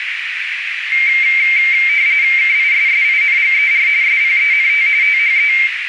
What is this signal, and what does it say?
RTTY (45.45 baud, 170 Hz shift), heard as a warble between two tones, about 2200 Hz centre, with radio static and a narrow filter. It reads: KISSINGER SPENT THE